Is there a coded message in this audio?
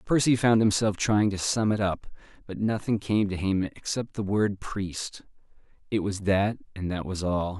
No, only speech in English.